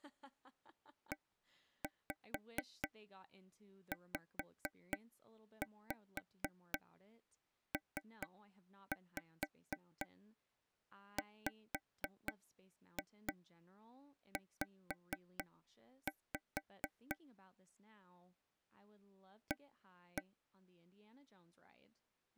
Tap code, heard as taps on a table, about 4 knocks a second, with speech in English. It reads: EZPWZ A